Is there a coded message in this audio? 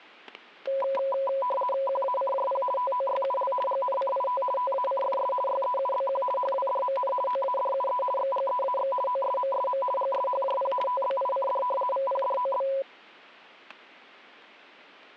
Yes: RTTY (50 baud, 450 Hz shift) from 0.7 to 12.8 s, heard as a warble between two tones, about 770 Hz centre, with static crashes. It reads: QACJP TOYUL GNCIT TACFS YEUBQ HWDMN OADUE XGEAX OSMSM GSHJP TBICD VPDOB